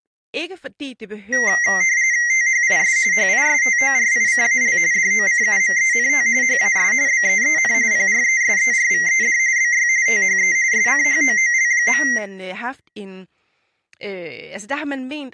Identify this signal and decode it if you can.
RTTY (45.45 baud, 170 Hz shift), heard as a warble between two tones, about 2000 Hz centre, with speech in Danish. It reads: THIS HISTORICAL DOCUMENT HAS BEEN PRESERVED BY THE SCHOOL.